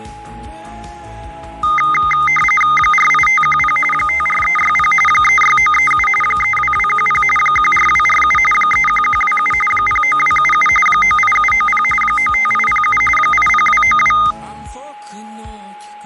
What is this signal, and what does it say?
RTTY (45.45 baud, 850 Hz shift), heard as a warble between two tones, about 1650 Hz centre, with a steady whistle near 830 Hz. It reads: 48510 54360 36937 32210 14247 31127 09277 98790 95807 80292